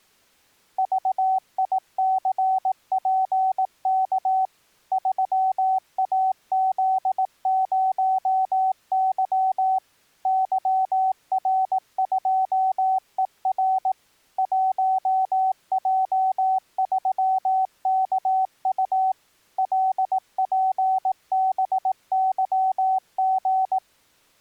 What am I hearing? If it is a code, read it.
Morse code, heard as a keyed tone, machine-sent, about 18 wpm, 760 Hz. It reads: VICPK 3AZ0Y YR2ER 1J3KU LPBYG